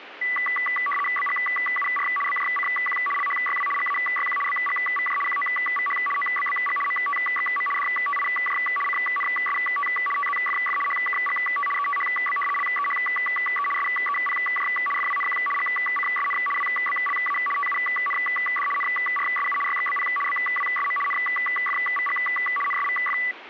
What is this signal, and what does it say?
RTTY (75 baud, 850 Hz shift), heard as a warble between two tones, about 1550 Hz centre, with radio static. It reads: BGUR BJCQ LHYW GAYQ BGVJ QOVH OBBG MTXM DTIJ CNST TZFF HKGT ETHB LEHE SEPJ FWNQ GCSN WBLA TUND NRSU YXBP BWSM NFVG NSVF